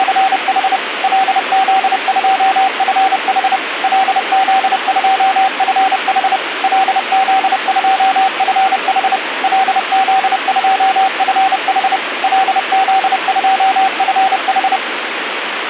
Morse code, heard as a keyed tone, machine-sent, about 30 wpm, 770 Hz, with radio hiss. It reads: … LZ2FH LZ2FH LZ2FH LZ2FH LZ2FH